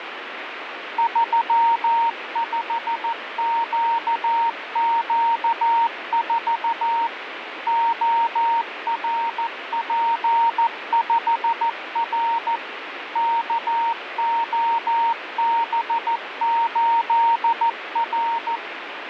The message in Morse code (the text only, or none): 35QQ4 ORP5R KOB8R